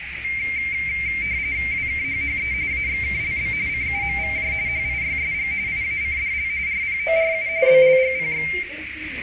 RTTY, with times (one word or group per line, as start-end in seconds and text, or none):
1.7-2.5 WKHHE
2.7-3.5 AXKLB
3.7-4.5 CUMVJ
4.7-5.5 HIYSG
5.7-6.5 IACDL
6.7-7.5 RPORU
7.7-8.5 BLGPX